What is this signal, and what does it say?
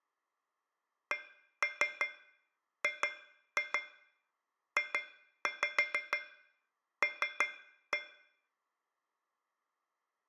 Tap code, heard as taps on a metal pipe, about 6 knocks a second, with room echo. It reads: CGJL